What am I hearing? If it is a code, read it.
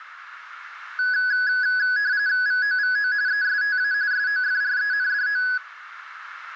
RTTY (45.45 baud, 170 Hz shift), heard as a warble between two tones, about 1600 Hz centre, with radio static. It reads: VOVO ESTA SOFRENDO